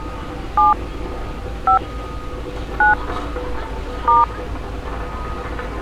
DTMF, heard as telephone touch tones, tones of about 180 ms, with street noise. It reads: 7 5 9 *